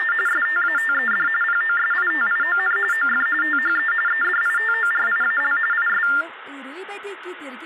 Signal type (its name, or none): TTY/TDD text telephone tones